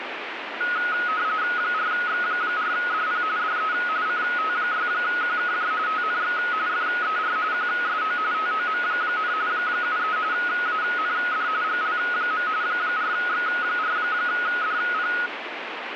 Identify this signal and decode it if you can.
RTTY (45.45 baud, 170 Hz shift), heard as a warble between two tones, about 1360 Hz centre, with radio static. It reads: 4X4DP DE CT6QKJ TNX FER QSO TOM, 73 AND GL. 4X4DP